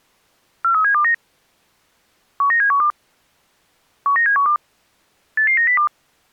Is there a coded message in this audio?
Yes: five-tone selective call (CCIR) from 0.6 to 5.9 s, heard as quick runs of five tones, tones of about 100 ms. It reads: 43729 19712 19712 88902